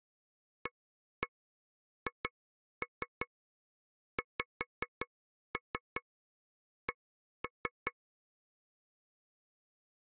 Tap code, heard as taps on a table, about 5 knocks a second. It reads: AHXC